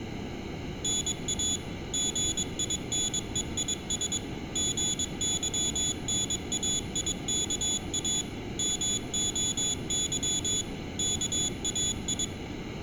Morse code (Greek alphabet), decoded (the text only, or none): ΝΑ ΓΙΝΕΙΣ ΓΥΝΑΙΚΑ ΜΟΥ ΚΑΙ